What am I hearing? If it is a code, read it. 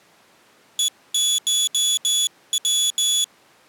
Morse code (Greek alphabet), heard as a high beeper, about 16 wpm, 3400 Hz. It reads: ΕΧΩ